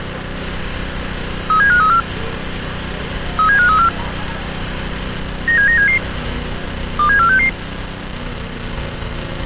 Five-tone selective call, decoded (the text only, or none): 37534 37534 97977 27466